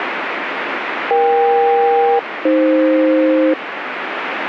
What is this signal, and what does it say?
Aircraft SELCAL, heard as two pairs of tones, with radio static. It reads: EK-AF